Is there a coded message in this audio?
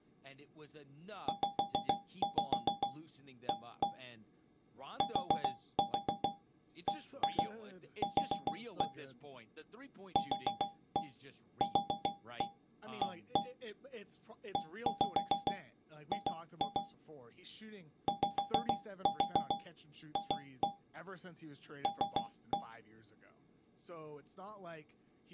Yes: tap code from 1.3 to 22.8 s, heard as taps on a metal pipe, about 7 knocks a second, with speech in English. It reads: ZA TBQ QQA EG YF L